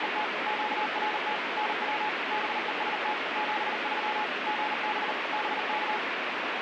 Morse code, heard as a keyed tone, machine-sent, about 39 wpm, 850 Hz, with heavy radio static. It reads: … QRT NW BEST 73 GB BK